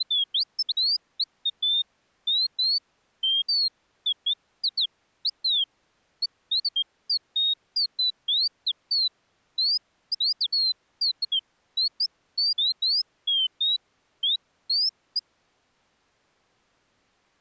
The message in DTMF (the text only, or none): none